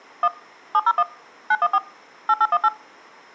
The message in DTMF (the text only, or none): 1 701 914 8818